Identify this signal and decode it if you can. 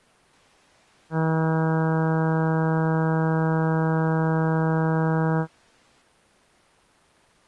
Ship horn signal, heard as a ship's horn, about 160 Hz. 1 long. At sea: a vessel nearing a blind bend, or under power and making way in fog.